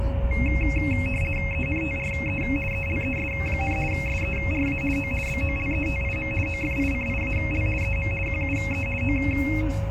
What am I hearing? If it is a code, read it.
RTTY (50 baud, 450 Hz shift), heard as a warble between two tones, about 2350 Hz centre, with a steady whistle near 550 Hz and the noise inside a car. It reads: ENTRE ELES, SERA O BOLETIM OFICIAL EM QUE O